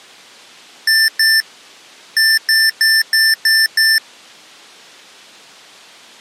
Beep code, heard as beeps from a small speaker, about 1800 Hz. 2-6.